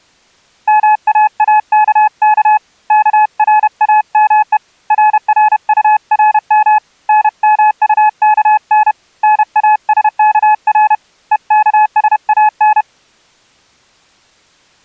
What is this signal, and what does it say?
Morse code, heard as a keyed tone, hand-sent with a paddle, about 31 wpm, 850 Hz. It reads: MAAKK KRAME RRURM NMUKN NASKR EKSAN